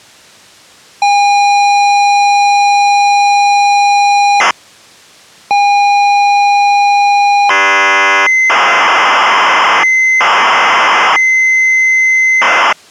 ZX Spectrum tape loading, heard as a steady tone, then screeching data.